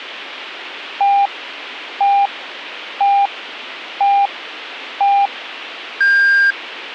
Radio time signal (five pips and a higher one, as on Chinese radio), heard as pips.